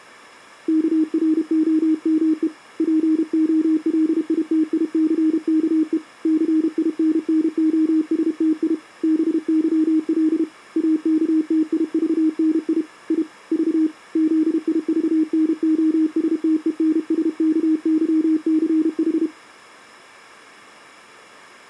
Morse code, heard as a keyed tone, hand-sent with a paddle, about 32 wpm, 310 Hz. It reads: KROME POLITICKE CINNOSTI BYL AKTIVNI I V ZIVNOSTENSKYCH